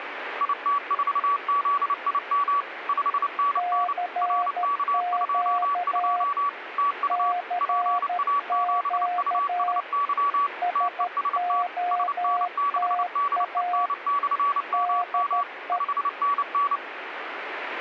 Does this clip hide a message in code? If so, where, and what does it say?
Yes: Morse code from 0.3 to 16.8 s, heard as two keyed tones, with radio static. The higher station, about 29 wpm, 1140 Hz: IT4ZIM 5NN RK22 TU PA7USY TEST SN6DEN/MM 5NN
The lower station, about 13 wpm, 710 Hz: CQ CQ SOTA DE